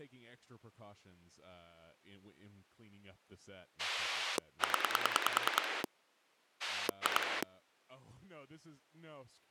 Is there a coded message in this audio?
Yes: pulse dialling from 3.8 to 7.4 s, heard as a rotary dial, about 10 pulses a second, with speech in English. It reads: 0 2